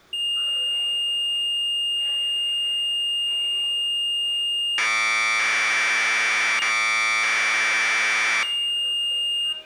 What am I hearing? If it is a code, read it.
Commodore tape loading (standard loader), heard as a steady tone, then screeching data, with room echo and the noise inside a subway train.